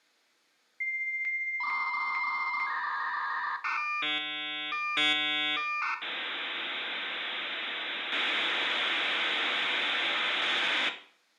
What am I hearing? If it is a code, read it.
Dial-up modem handshake (V.34 or later), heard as a whistle, warbles, then hiss, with room echo.